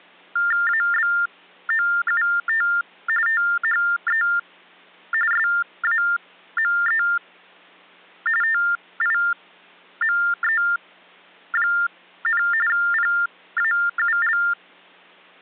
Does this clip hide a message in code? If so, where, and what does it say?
Yes: TTY/TDD text telephone tones (45.45 baud Baudot) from 0.4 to 14.5 s, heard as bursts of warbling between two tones, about 400 Hz shift, 1600 Hz centre. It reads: ABOUT THE SAME TIME, PAUL